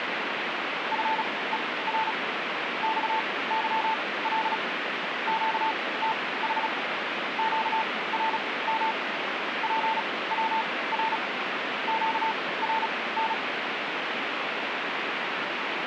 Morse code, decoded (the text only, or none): FER XYL QTH QRM PWR QRN